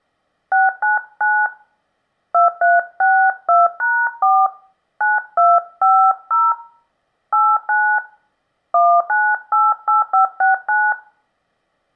DTMF, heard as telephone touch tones, dialled by hand, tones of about 210 ms, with room echo. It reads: 699 2362#4 9250 89 1988569